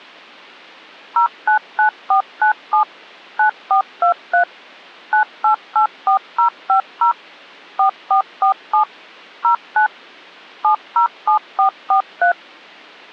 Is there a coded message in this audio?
Yes: DTMF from 1.2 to 12.3 s, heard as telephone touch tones, dialled by machine, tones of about 100 ms. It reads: 099497 9423 9884050 4447 09 707443